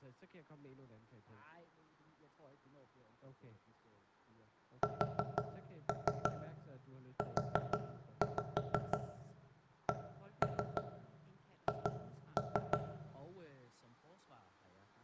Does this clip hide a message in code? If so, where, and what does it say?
Yes: tap code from 4.8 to 12.8 s, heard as knocks on wood, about 6 knocks a second, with room echo and speech in Danish. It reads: SUCH